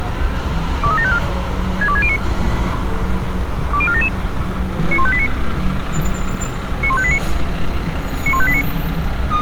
Five-tone selective call (ZVEI), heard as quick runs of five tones, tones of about 70 ms, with street noise. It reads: 23754 62609 20477 91589 91589 91589